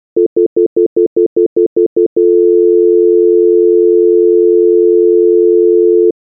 Telephone call progress tone (North American plan), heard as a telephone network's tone, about 350, 440 Hz, 0.1 s on and 0.1 s off. Stutter dial tone.